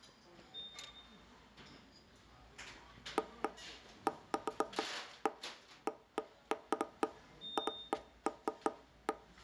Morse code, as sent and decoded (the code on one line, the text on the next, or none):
none